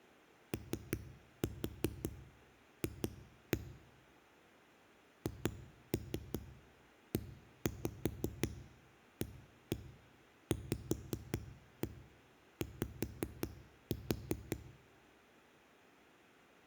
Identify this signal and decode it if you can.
Tap code, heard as knocks on a wall, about 5 knocks a second, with room echo. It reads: OF HEAVY